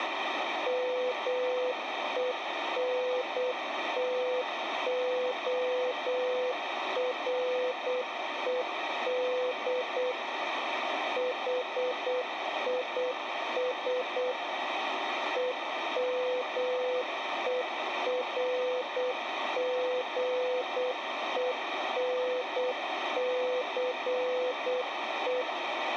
Morse code, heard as a keyed tone, machine-sent, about 8 wpm, 500 Hz, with radio static. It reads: MENTORED HIS EMERGENCE